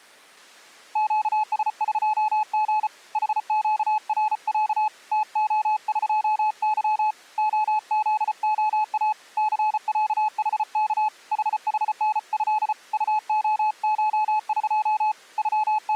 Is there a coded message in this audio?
Yes: Morse code (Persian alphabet) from 0.9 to 16.0 s, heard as a keyed tone, hand-sent with a paddle, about 34 wpm, 860 Hz. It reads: گسقژ حگرص تعقظ عزعا ثصحک ححنض طعشق …